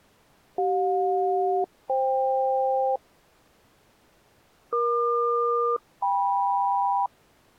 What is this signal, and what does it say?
Aircraft SELCAL, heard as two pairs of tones. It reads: CJ-FK EQ-KM